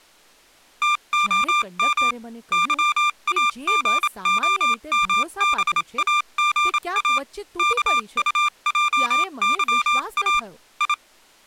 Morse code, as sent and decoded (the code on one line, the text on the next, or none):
- --- -- / -.-- .- --. --- -- -... .- --. .- / -.- ..- .--- -.-- .- / ..
TOM YAGOMBAGA KUJYA I